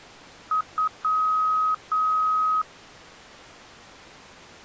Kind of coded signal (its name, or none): beep code